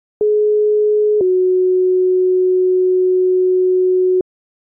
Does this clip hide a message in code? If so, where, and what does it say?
Yes: two-tone page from 0.2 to 4.2 s, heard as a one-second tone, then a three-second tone, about 420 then 370 Hz.